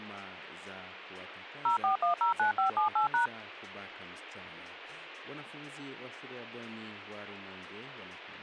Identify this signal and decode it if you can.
DTMF, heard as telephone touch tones, dialled by machine, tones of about 120 ms. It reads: 04109578#